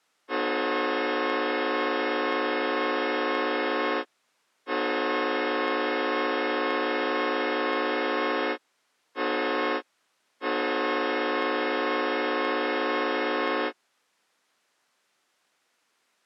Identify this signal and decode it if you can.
Train horn signal, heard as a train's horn. 2 long, 1 short, 1 long. On North American railways: approaching a public crossing.